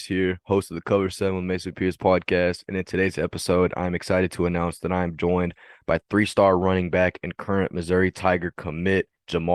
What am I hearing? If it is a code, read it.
Speech in English. There is no code.